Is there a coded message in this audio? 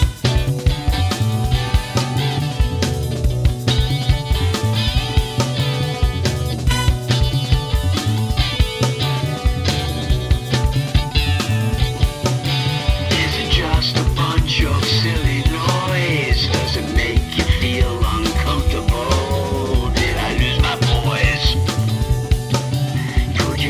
No.